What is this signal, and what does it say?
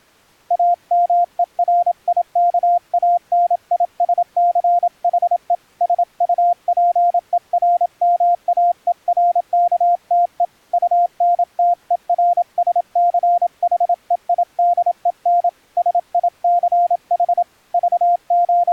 Morse code, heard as a keyed tone, hand-sent with a paddle, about 27 wpm, 700 Hz. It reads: AMERIKANISCHE SUPERMAERKTE UNTERSCHEIDEN SICH …